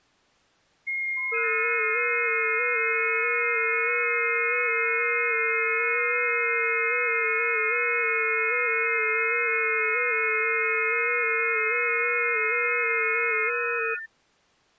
FT8 (several signals at once), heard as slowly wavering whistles, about 6.25 baud.